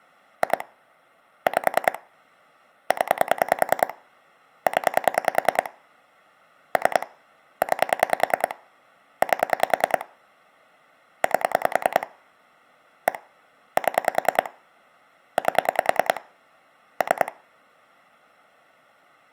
Pulse dialling, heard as clicks on a phone line, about 10 pulses a second. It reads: 2 5 0 0 3 9 8 8 1 7 8 3